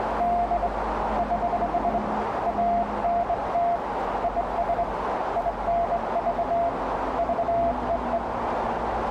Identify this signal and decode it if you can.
Morse code, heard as a keyed tone, hand-sent with a straight key, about 22 wpm, 690 Hz, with radio static, a narrow filter and the noise of a residential street. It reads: … <HH> ANT IS INV VEE